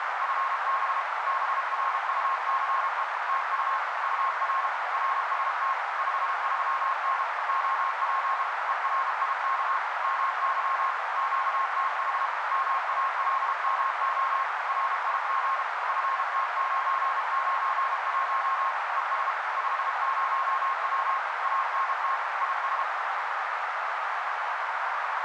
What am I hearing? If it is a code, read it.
Morse code, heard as a keyed tone, machine-sent, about 32 wpm, 1070 Hz, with heavy radio static and a narrow filter. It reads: FB BRUCE TU UR RST 53N OP ERIK MY QTH MALMO RIG FT991 ES 50W ANT IS